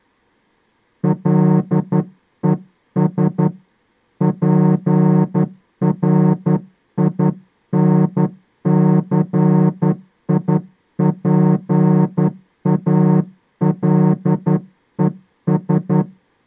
Morse code, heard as a horn, hand-sent with a straight key, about 11 wpm. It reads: LES PRINCIPALES